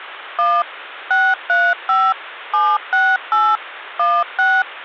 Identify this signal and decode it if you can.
DTMF, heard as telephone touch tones, dialled by machine, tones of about 230 ms. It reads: 1 635 768 16